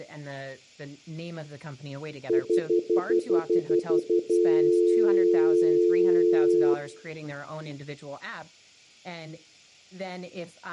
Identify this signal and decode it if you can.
Telephone call progress tone (North American plan), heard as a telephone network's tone, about 350, 440 Hz, 0.1 s on and 0.1 s off, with room echo and speech in English. Stutter dial tone.